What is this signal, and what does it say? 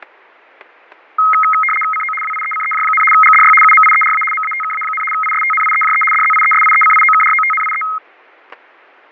RTTY (75 baud, 850 Hz shift), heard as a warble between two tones, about 1700 Hz centre, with fading and static crashes. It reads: CO WIECEJ, GDY UMIERA MATKA, ISTNIEJE DZIESIECIOKROTNIE